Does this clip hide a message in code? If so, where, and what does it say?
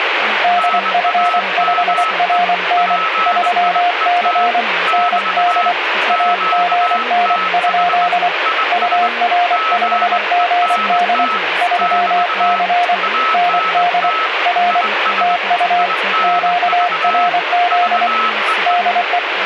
Yes: Morse code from 0.4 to 19.2 s, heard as two keyed tones, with radio static and speech in English. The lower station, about 24 wpm, 710 Hz: DF5RN 3C ND AGN? UR5GD 3C ND R TU QRZ DE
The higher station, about 21 wpm, 1300 Hz: NAME PIET <BT> QTH IS GENT <BT> ANT IS INV VEE